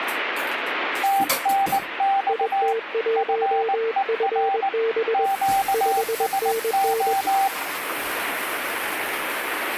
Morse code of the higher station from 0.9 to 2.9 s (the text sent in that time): TNX